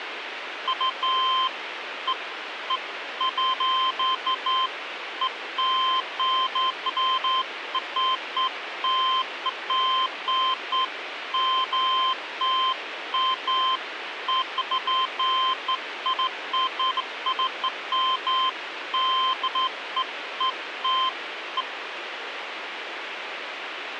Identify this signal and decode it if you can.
Beeps of irregular length, with radio hiss. There is no code.